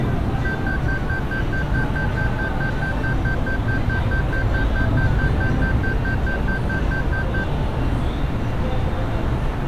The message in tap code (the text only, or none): none